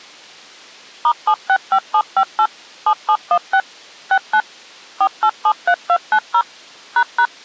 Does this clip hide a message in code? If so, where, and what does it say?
Yes: DTMF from 1.0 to 7.3 s, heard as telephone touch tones, dialled by machine, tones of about 70 ms. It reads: *765758 7716 69 4873290 ##